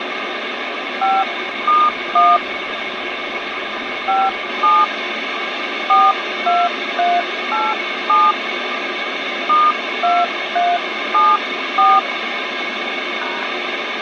DTMF, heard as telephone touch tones, dialled by hand, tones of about 210 ms, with phone line noise. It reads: 5*1 57 42387 *2374 #